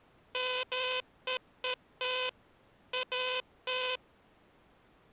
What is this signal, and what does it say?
Morse code, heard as a buzzer, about 13 wpm. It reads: MEET AT